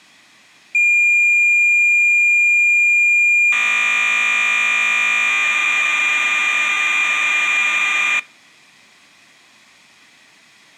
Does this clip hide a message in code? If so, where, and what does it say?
Yes: cassette data (Kansas City type), 1200 baud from 0.7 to 8.2 s, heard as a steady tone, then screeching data.